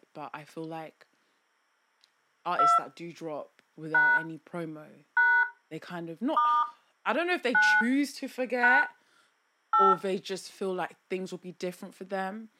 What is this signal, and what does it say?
DTMF, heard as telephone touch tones, dialled by hand, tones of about 220 ms, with speech in English. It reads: 2 # # * 9 # 8